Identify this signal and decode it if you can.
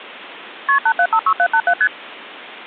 Multi-frequency trunk signalling (R1, as on North American trunks), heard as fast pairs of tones, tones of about 70 ms. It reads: KP 8756787 ST